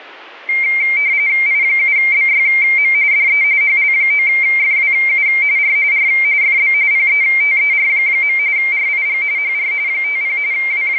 RTTY (45.45 baud, 170 Hz shift), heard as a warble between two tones, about 2200 Hz centre. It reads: I7BYM DE HL9FWU R R FB PETER. RIG HR 50 …